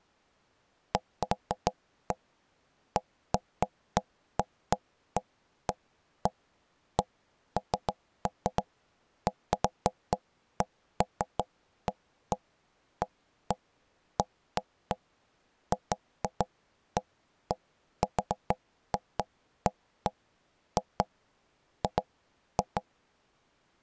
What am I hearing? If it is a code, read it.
Irregular knocks on wood. There is no code.